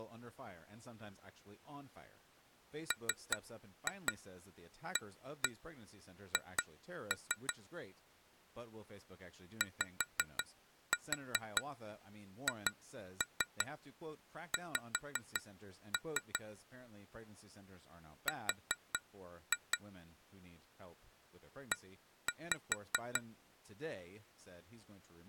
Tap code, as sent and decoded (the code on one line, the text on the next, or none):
3-2 1-1 2-3 / 5-4 2-3 5-3 / 4-2 / 1-5
MAH YHX R E